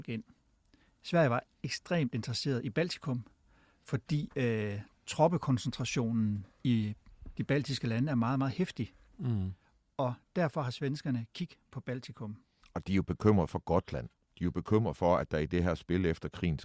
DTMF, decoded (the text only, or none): none